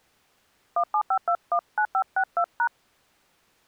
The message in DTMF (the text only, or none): 175219562#